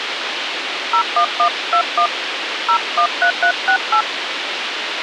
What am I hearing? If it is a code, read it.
DTMF, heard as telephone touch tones, dialled by hand, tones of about 90 ms, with radio hiss and a squelch burst at the end. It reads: 01121 013368